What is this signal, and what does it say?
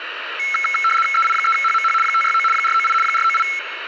RTTY (75 baud, 850 Hz shift), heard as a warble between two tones, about 1750 Hz centre, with radio static. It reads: EI3HMH 569 498 498